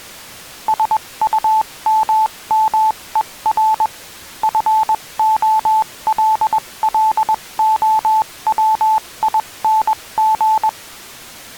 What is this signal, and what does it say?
Morse code, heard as a keyed tone, machine-sent, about 21 wpm, spaced as for 18 wpm, 870 Hz. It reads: SUMMER FOLLOWING